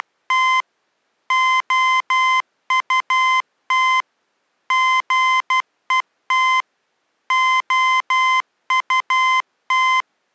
Morse code, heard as electronic beeps, machine-sent, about 12 wpm, 1030 Hz. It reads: … OUT GET OUT